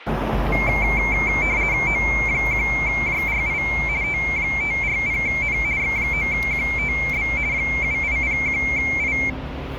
RTTY (50 baud, 170 Hz shift), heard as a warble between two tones, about 2250 Hz centre, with radio static and street noise. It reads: O1JRI T540N X9QTB 7801I